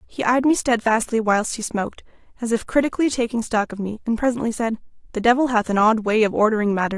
Speech in English. There is no code.